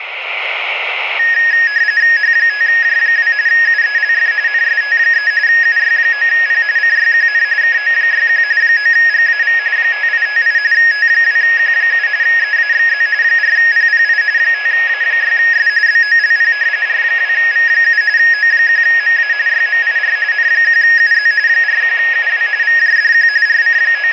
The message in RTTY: H5J2 UELF NST3 UY9P CYQN KO61 9GAV 5858 T2Q7 EAXZ 4PPI 5A6S BOLP R2V7 O1MA YMIR N1UZ 41UW VJDQ …

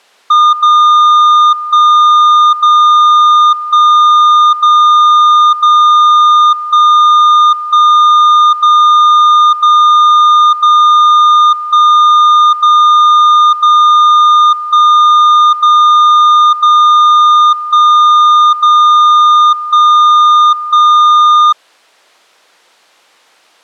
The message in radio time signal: 0 1 0 1 0 0 1 1 0 0 0 1 0 0 1 0 0 1 0 1 1

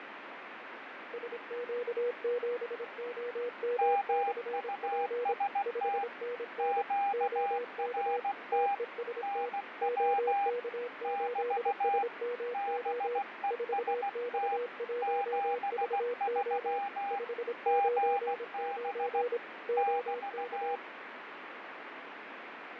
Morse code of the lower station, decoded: SQ7OM/P 5NN OK TEST OK8SMO 4X1VO 599 OK

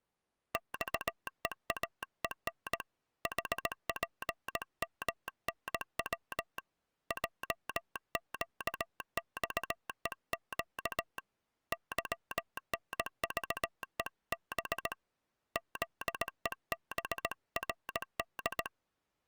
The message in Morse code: XEAEN HPMNW JQXEQ YNVEB ZEBRD

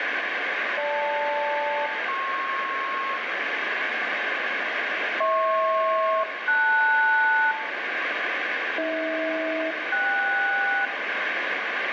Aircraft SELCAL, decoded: GL-PR HP-LS AH-KS

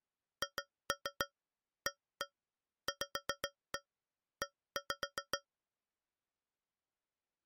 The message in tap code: HAVE

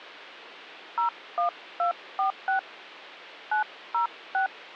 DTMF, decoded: 01246 906

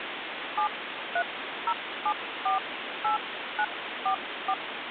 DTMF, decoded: 730748944

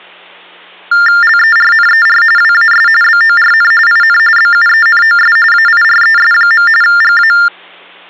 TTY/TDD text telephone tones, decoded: LERNER WAS BORN IN BUENOS AIRES. GA

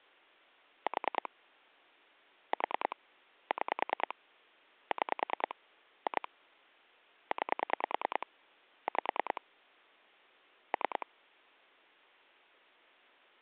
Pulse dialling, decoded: 4 4 6 6 2 9 5 3

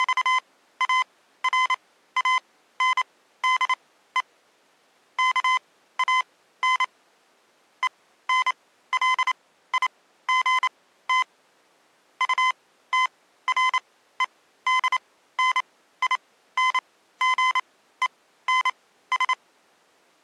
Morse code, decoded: … KAN ENLIGT UTREDNINGENS

